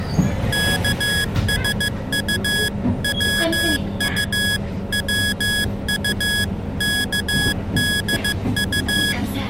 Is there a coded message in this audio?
Yes: Morse code (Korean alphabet) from 0.5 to 9.2 s, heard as electronic beeps, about 15 wpm, 1650 Hz, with the noise inside a bus. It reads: 예비비의